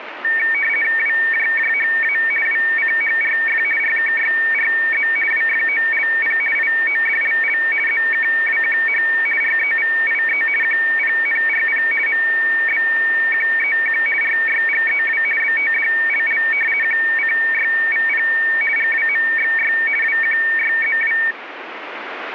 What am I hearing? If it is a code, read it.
RTTY (50 baud, 450 Hz shift), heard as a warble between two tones, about 2050 Hz centre, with radio static. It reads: WJJHA WCHRF RKYRZ WFOLP IODLL ZKWQH REVIE QPNRP MBQEQ RYGEW BTDLL QCYVP GWMXY WQYZW